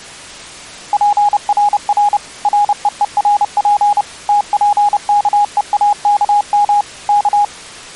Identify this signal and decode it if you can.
Morse code, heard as a keyed tone, machine-sent, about 30 wpm, 820 Hz. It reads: PRR REERP TPKEAKM K